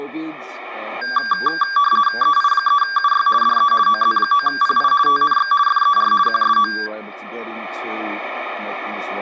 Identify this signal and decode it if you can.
RTTY (50 baud, 450 Hz shift), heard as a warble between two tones, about 1370 Hz centre. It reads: EI3UY DE OZ9PI TNX FER QSO